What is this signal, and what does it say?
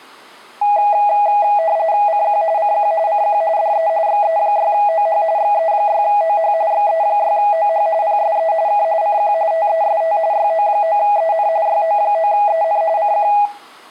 RTTY (45.45 baud, 170 Hz shift), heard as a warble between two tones, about 740 Hz centre, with room echo. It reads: CQ CQ CQ DE XE6OH XE6OH XE6OH PSE K CQ TEST YO9EN YO9EN CQ